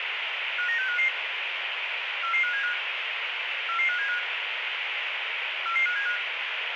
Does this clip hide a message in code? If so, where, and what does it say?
Yes: five-tone selective call (CCIR) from 0.6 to 6.2 s, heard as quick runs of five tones, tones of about 100 ms, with radio hiss. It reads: 59655 44575 44575 44575